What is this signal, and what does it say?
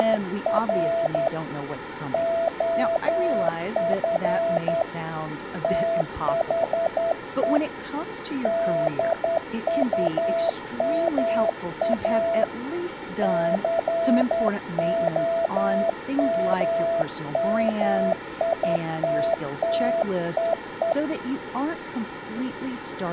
Morse code, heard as a keyed tone, hand-sent with a straight key, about 10 wpm, 670 Hz, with room echo and speech in English. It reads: … OF THE DUMA COMMITTEE